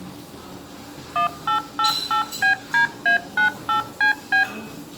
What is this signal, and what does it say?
DTMF, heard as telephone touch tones, dialled by machine, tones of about 110 ms, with room echo and the noise of a restaurant. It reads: 1888BDA98CB